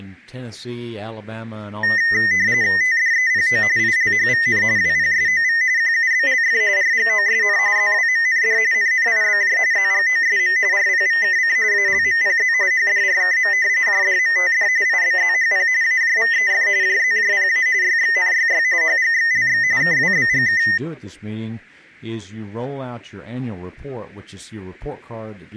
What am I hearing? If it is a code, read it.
RTTY (45.45 baud, 170 Hz shift), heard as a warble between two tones, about 1950 Hz centre. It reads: TDEPO ILHVN WPSOV QUBLF RGOSN ZWMND NNIBJ ZGOSM RPVKC ALMPZ HDRKM JDMTD IBZHP AJVEF JZJPA YXNYY HGXLX KWBGK